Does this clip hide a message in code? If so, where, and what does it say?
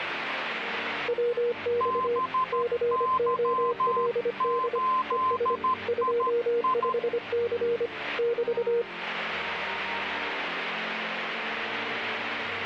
Yes: Morse code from 1.0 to 8.9 s, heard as two keyed tones, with radio static. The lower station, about 25 wpm, 480 Hz: WX COLD ES 25C <BT>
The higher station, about 13 wpm, 1040 Hz: BY8II